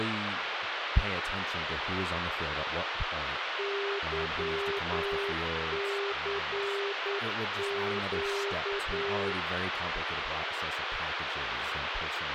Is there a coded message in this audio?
Yes: Morse code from 3.5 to 9.4 s, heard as a keyed tone, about 9 wpm, 400 Hz, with radio hiss and speech in English. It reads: YCQ